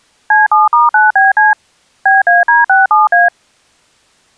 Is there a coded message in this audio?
Yes: DTMF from 0.3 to 3.3 s, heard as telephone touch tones, dialled by machine, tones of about 160 ms. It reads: C7*9BC BAD67A